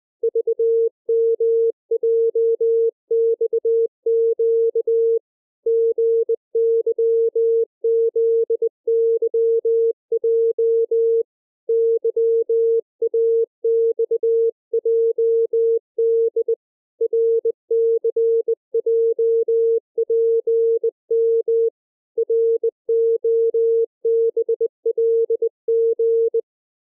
Morse code, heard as a keyed tone, hand-sent with a bug key, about 20 wpm, 460 Hz. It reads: VMJXQ GYZYJ YAXJD RCJPM ROBLG